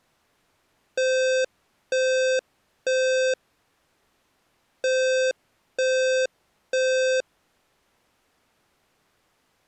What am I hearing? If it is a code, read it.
Alarm pattern, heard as an alarm's beeps, played twice, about 520 Hz. Temporal three. Smoke or fire, evacuate.